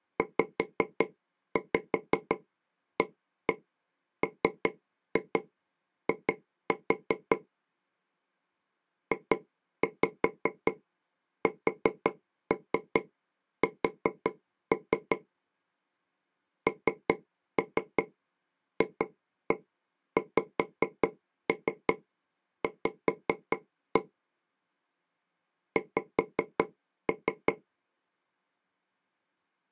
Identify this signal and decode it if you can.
Tap code, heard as taps on a table, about 5 knocks a second. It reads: ZAMI JSS NFXV X